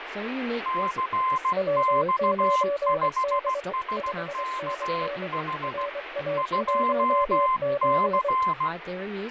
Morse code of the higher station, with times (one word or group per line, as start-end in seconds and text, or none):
0.7-5.9 CX5SKH
6.4-8.7 2C